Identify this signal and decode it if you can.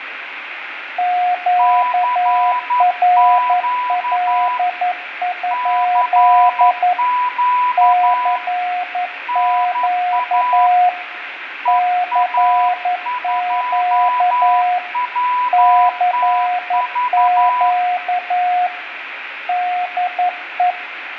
Morse code, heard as two keyed tones, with radio static, fading and room echo. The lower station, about 11 wpm, 720 Hz: QRL? CQ CQ CQ DE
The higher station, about 11 wpm, 990 Hz: CQ CQ NA EA2WTV